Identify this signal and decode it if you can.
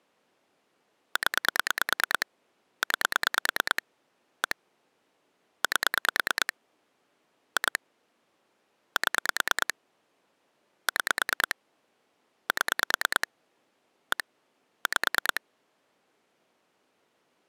Pulse dialling, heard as clicks on a phone line, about 9 pulses a second. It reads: 0 9 1 8 2 7 6 7 1 5